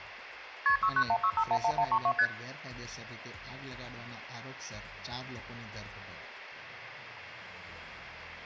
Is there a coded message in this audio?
Yes: multi-frequency trunk signalling (R1, as on North American trunks) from 0.7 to 2.3 s, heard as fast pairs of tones, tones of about 70 ms. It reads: KP 6916511132 ST